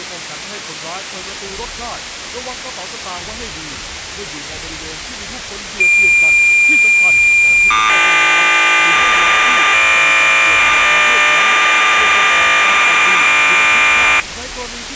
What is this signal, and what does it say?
Cassette data (Kansas City type), 1200 baud, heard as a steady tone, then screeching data.